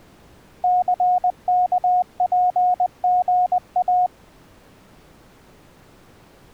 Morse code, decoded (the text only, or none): CKPGA